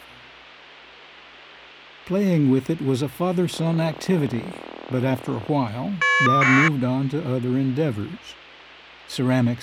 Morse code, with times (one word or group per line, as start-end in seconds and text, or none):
none